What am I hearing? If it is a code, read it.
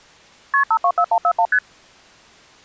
Multi-frequency trunk signalling (R1, as on North American trunks), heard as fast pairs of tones, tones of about 70 ms. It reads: KP 524141 ST